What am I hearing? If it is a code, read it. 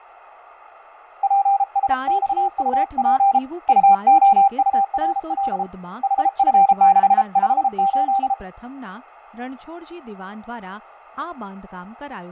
Morse code, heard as a keyed tone, hand-sent with a paddle, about 33 wpm, 790 Hz, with radio static, fading and speech in Gujarati. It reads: PSXUP UOURL HF658